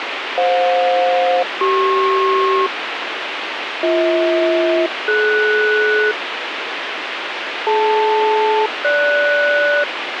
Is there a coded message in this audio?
Yes: aircraft SELCAL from 0.4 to 9.8 s, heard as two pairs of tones, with radio hiss. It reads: FJ-CP BH-DS DL-GS